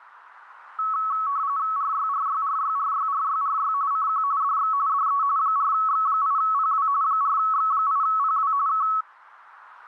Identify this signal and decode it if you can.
RTTY (45.45 baud, 170 Hz shift), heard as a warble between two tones, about 1210 Hz centre, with radio static. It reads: RYRYRYRYRYRY CQ DX DE 4X8PW 4X8PW K